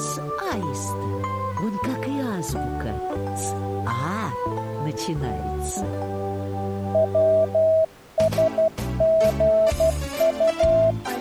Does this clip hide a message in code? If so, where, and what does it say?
Yes: Morse code (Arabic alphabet) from 6.9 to 11.0 s, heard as a keyed tone, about 12 wpm, 650 Hz. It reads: وسغط